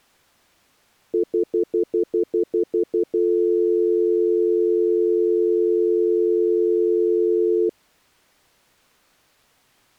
Telephone call progress tone (North American plan), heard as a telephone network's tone, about 350, 440 Hz, 0.1 s on and 0.1 s off. Stutter dial tone.